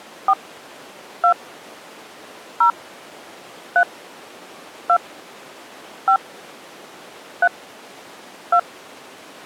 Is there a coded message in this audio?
Yes: DTMF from 0.3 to 8.6 s, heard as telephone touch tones, dialled by hand, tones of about 80 ms. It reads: 4 2 0 3 2 5 3 2